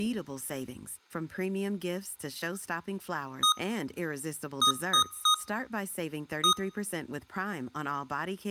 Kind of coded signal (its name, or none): beep code